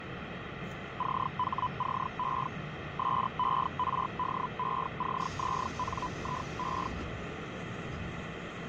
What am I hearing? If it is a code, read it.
Hellschreiber (Feld-Hell, 122.5 baud), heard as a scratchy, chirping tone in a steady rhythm, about 1000 Hz, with radio static, fading and the noise inside a subway train. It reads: CHCE SERDECZNIE